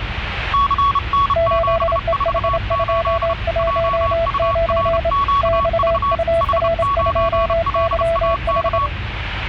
Morse code, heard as two keyed tones, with radio static and the noise inside a car. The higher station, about 31 wpm, 1120 Hz: CN748 JURQV H9LAK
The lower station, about 27 wpm, 670 Hz: 8EH219 XUR2YH